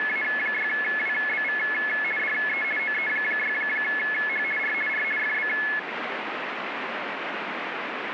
RTTY (50 baud, 450 Hz shift), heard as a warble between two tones, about 1950 Hz centre, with radio static. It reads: … DE OE6H R R FB